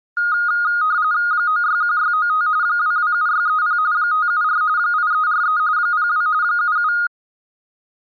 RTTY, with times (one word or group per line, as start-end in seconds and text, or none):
1.3-2.5 961695
2.6-3.8 227630
3.9-4.6 574
4.8-5.6 8343
5.8-6.3 02
6.4-6.9 77